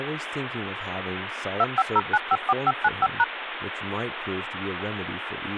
DTMF, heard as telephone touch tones, dialled by machine, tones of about 40 ms, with phone line noise and speech in English. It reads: 250954595#